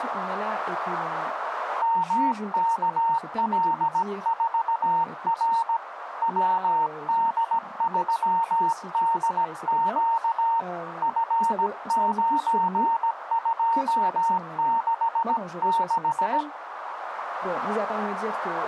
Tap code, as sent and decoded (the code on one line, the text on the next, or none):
none